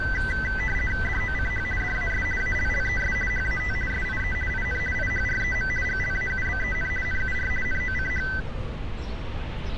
RTTY (50 baud, 450 Hz shift), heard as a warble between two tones, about 1750 Hz centre, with street noise. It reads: DOCH DAS ALLES HAT SIE IN IHREM GLAUBEN NUR NOCH